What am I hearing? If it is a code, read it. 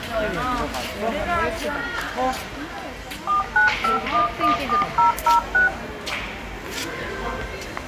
DTMF, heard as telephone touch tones, dialled by machine, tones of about 130 ms, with the noise of a crowd indoors. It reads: 495114006